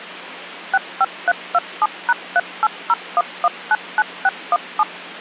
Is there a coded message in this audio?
Yes: DTMF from 0.7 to 4.8 s, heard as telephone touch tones, dialled by machine, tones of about 40 ms, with phone line noise. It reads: 65327#3801199617